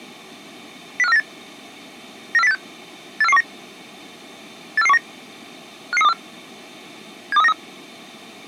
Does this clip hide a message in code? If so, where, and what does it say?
Yes: five-tone selective call (EEA) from 1.0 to 7.5 s, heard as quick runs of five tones, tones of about 40 ms. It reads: 05498 94086 84419 84419 55324 72393